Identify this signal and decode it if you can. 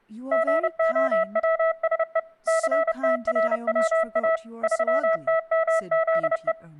Morse code, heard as a keyed tone, machine-sent, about 30 wpm, 650 Hz, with speech in English. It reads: GOWSE CTRWA 3TMZE